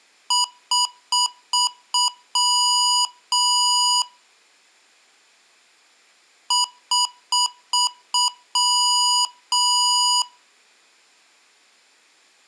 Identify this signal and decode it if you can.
Beep code, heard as beeps from a small speaker, played twice, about 980 Hz. 5 short, 2 long.